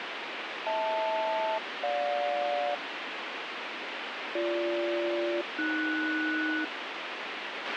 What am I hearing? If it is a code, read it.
Aircraft SELCAL, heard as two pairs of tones, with radio hiss and a squelch burst at the end. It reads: HL-GJ BG-AS